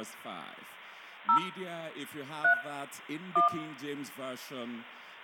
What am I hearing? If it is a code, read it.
DTMF, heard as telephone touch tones, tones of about 120 ms, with room echo. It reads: 0 3 1